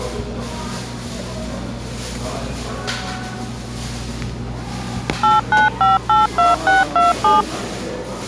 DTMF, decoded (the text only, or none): 89582627